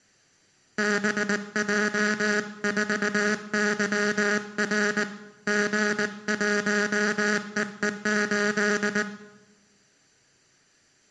Morse code, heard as a buzzer, hand-sent with a paddle, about 19 wpm, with room echo. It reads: BJ4YR G1EE8